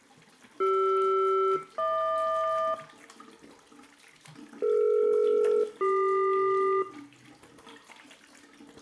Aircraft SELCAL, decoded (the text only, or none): CR-HQ DE-CQ